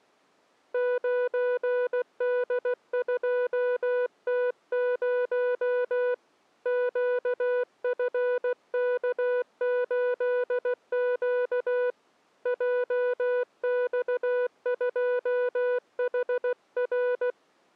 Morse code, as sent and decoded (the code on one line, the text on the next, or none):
----. -.. ..--- - ----- / --.- ..-. -.- ---.. --.- / .--- -..- ..--- .... .-.
9D2T0 QFK8Q JX2HR